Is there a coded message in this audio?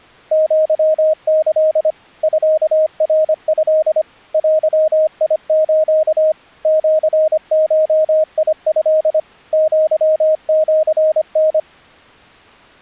Yes: Morse code (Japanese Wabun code) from 0.3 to 11.7 s, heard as a keyed tone, machine-sent, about 25 wpm, 620 Hz. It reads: アキ ミナト デス シゴト アシタ